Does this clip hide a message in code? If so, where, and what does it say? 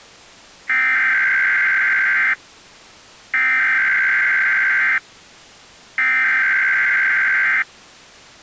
Yes: Emergency Alert System (SAME) tones (header bursts) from 0.7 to 7.6 s, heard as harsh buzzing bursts, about 520.83 baud.